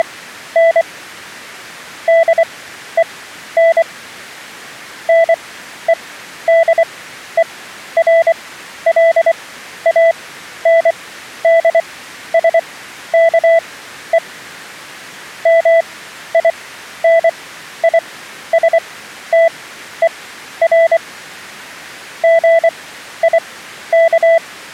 Morse code, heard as a keyed tone, machine-sent, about 24 wpm, spaced as for 12 wpm, 660 Hz. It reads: … DEN NEDERLANDSKE MINISTER GIK